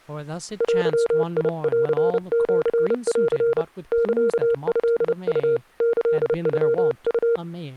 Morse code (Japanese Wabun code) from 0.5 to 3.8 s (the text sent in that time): デンシン